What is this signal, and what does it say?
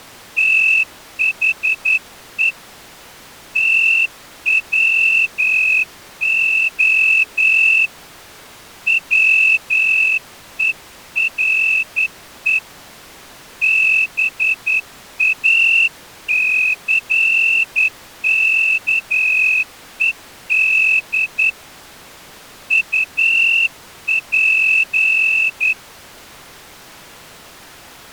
Morse code, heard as a whistle, hand-sent with a straight key, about 10 wpm. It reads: THE TWO WERE BACKED UP